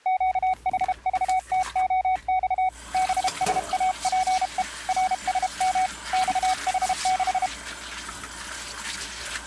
Morse code, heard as a keyed tone, hand-sent with a paddle, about 32 wpm, 750 Hz, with kitchen noise. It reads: QHVTOX BSAPE RSM XH6